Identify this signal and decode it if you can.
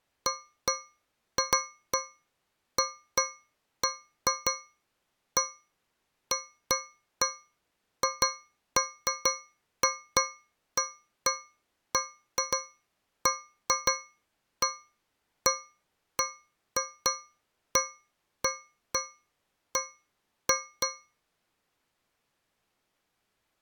Irregular taps on a metal pipe. There is no code.